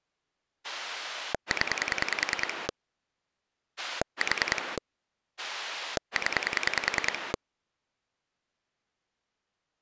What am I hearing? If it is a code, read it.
Pulse dialling, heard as a rotary dial, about 10 pulses a second. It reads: 0 4 0